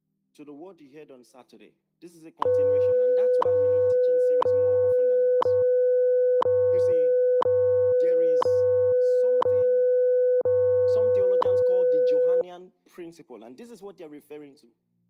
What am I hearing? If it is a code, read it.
Radio time signal (WWV, Colorado), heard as ticks, one a second.